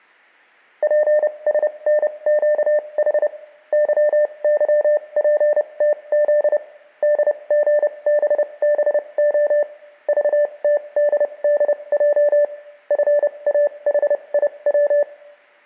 Morse code, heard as a keyed tone, machine-sent, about 30 wpm, spaced as for 24 wpm, 590 Hz, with room echo. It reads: PSNQH YYPTZ DGBBO VTDDJ FAHIW